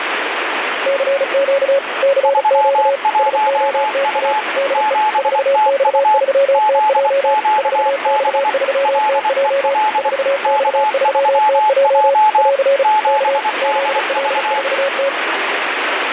Morse code, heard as two keyed tones, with radio static. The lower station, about 35 wpm, 550 Hz: CQ CQ SOTA DE 4X3TJ 4X3TJ 4X3TJ <AR> K ZL4T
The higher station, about 24 wpm, 860 Hz: 31U 7TU ZQB LEL K3J 7DV